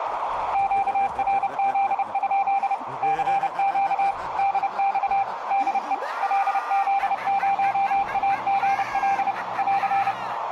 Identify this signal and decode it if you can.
Morse code, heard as a keyed tone, machine-sent, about 30 wpm, 790 Hz, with radio static and a narrow filter. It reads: QRZ? CQ DX DE LZ0AGL <AR>